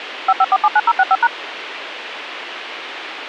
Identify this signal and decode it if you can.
DTMF, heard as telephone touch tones, dialled by machine, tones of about 50 ms, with radio hiss. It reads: 55479065#